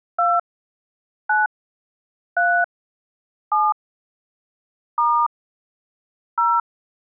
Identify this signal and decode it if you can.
DTMF, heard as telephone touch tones, dialled by hand, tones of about 230 ms. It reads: 2 9 3 7 * 0